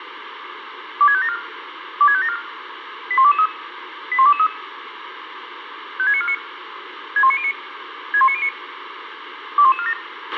Five-tone selective call (ZVEI), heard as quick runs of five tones, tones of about 70 ms, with radio hiss and a squelch burst at the end. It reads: 26574 26574 81223 81223 56949 61909 61909 21147